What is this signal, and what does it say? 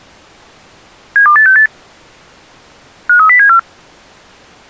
Five-tone selective call (CCIR), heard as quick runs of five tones, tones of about 100 ms. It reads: 72868 53074